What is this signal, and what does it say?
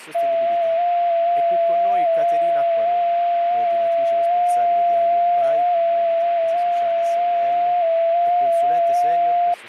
FT8 (one signal), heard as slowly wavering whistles, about 6.25 baud, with speech in Italian.